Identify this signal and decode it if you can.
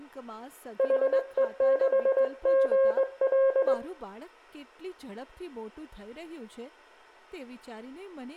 Morse code, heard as a keyed tone, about 20 wpm, 540 Hz, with room echo and speech in Gujarati. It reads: HE6GL